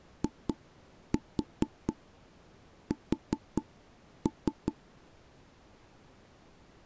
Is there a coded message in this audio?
Yes: tap code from 0.2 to 4.8 s, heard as knocks on wood, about 4 knocks a second. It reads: IS